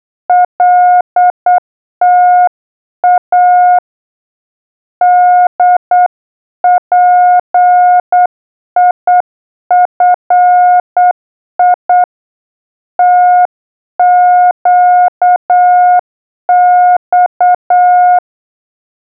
Morse code, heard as a keyed tone, hand-sent with a straight key, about 8 wpm, 720 Hz. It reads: LTA DPIFI TQX